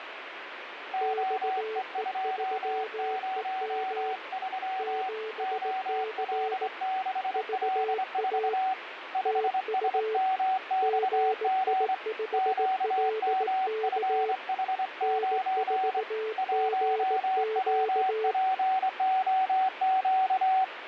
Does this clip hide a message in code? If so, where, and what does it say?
Yes: Morse code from 0.9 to 20.7 s, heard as two keyed tones, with radio static and fading. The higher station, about 24 wpm, 760 Hz: OE203 OL6L4 5SMXG QMFH9 1WPOQ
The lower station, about 18 wpm, 440 Hz: XE3EM 7C VA TU GI5LK N4GQ